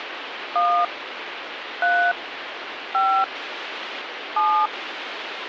DTMF, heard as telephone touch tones, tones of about 290 ms, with phone line noise. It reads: 1 3 5 7